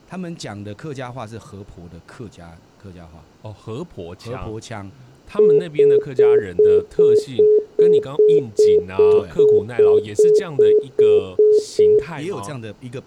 Telephone call progress tone (single-tone plan, as in most of Europe), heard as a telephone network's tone, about 420 Hz, 0.2 s on and 0.2 s off, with room echo and speech in Chinese. Congestion tone.